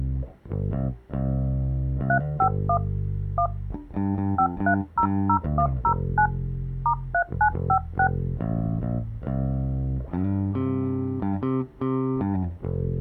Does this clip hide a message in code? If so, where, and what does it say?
Yes: DTMF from 2.1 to 8.1 s, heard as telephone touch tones, dialled by hand, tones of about 80 ms. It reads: 351 1 5300109 *3956